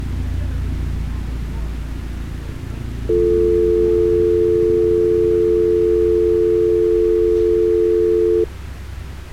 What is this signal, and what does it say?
Telephone call progress tone (North American or UK plan), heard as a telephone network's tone, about 350, 440 Hz, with street noise. Dial tone.